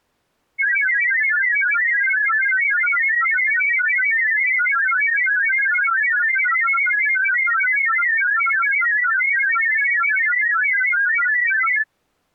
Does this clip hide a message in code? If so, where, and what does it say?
Yes: multi-tone FSK (Olivia or MFSK type), about 1000 Hz wide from 0.6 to 11.9 s, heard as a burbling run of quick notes, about 31.25 baud.